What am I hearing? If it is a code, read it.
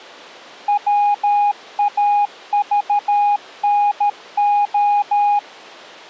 Morse code (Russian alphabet), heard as a keyed tone, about 13 wpm, 820 Hz. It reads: ВАЖНО